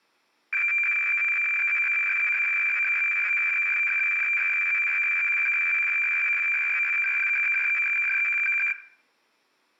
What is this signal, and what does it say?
Weather fax (radiofax), 120 lines a minute, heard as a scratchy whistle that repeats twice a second, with room echo.